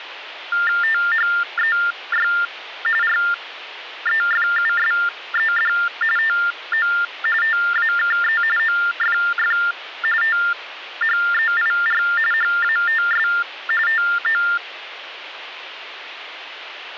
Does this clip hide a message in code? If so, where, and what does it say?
Yes: TTY/TDD text telephone tones (45.45 baud Baudot) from 0.5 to 14.6 s, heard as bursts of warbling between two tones, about 400 Hz shift, 1600 Hz centre, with phone line noise. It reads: THEY REFUSED TO TAKE OFF THEIR HATS TO